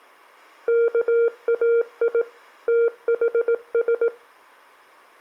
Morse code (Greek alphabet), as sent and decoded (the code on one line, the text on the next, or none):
-.- .- .. / - .... ...
ΚΑΙ ΤΗΣ